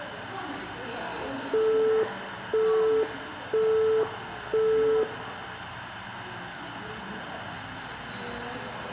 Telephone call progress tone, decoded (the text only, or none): busy tone